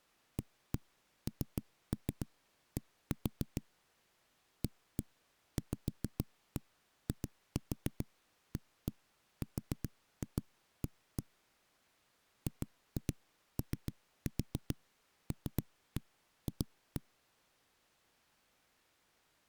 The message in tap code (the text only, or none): AND AVIARA GOLF